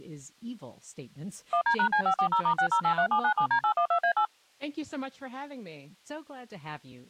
DTMF, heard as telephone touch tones, dialled by machine, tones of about 90 ms, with speech in English. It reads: 1D#C540*6083797D812A8